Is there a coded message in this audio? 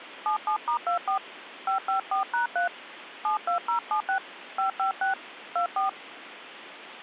Yes: DTMF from 0.3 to 5.9 s, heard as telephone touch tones, dialled by hand, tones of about 120 ms, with phone line noise. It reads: 77*24 554#3 72076 556 24